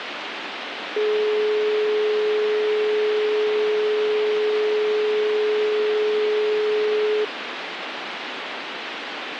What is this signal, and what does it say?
Telephone call progress tone (425 Hz plan, as in most of Europe), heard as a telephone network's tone, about 420 Hz, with phone line noise. Dial tone.